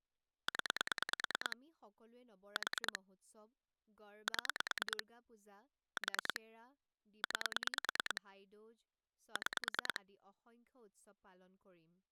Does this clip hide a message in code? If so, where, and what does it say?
Yes: pulse dialling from 0.5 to 10.0 s, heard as clicks on a phone line, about 9 pulses a second, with speech in Assamese. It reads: 0 4 7 4 9 6